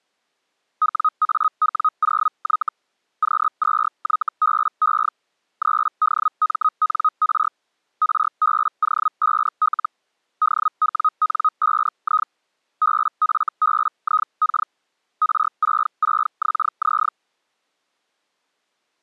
Hellschreiber (Feld-Hell, 122.5 baud), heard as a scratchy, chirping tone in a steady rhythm, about 1260 Hz. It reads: WAW0Y Q2YBE 3DMNR RBO5L DWN5I BFBIK R66XZ